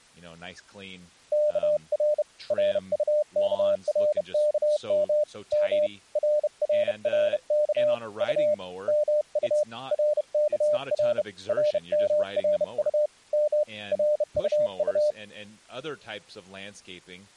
Morse code, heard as a keyed tone, hand-sent with a bug key, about 31 wpm, 600 Hz, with speech in English. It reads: KR RUKRKM M RRRK U MU RKR RMRU M RUU